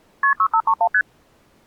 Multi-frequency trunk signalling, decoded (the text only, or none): KP 6531 ST